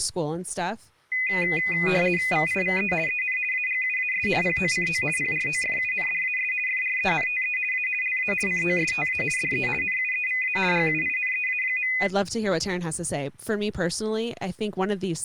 RTTY (50 baud, 450 Hz shift), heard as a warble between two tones, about 2250 Hz centre, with speech in English. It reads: VIVE EN AGUAS POCO PROFUNDAS FRENTE A LA COSTA DE NUEVA GUINEA.